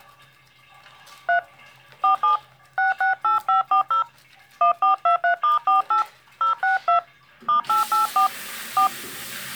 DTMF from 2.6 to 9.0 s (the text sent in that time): 668540 1423*48 062 *884 4